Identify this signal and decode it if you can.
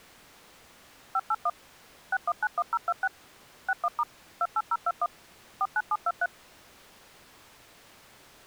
DTMF, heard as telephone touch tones, dialled by machine, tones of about 50 ms. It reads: 581 6191026 61* 28021 49723